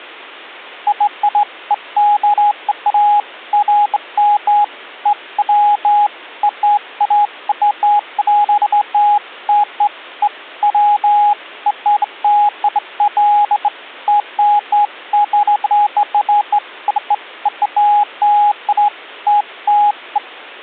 Beeps of irregular length. There is no code.